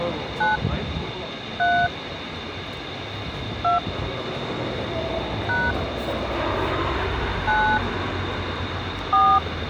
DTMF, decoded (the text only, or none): 9 3 2 # 9 4